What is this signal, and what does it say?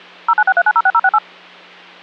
DTMF, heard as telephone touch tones, dialled by machine, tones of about 50 ms, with hum. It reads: 0963906068